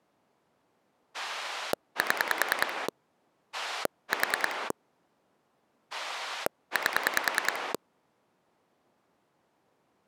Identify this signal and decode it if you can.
Pulse dialling, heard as a rotary dial, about 10 pulses a second. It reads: 7 4 8